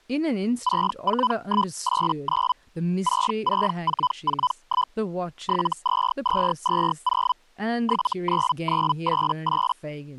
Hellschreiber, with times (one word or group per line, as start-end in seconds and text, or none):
0.6-2.5 64189
3.0-4.9 66441
5.4-7.3 72220
7.8-9.7 79988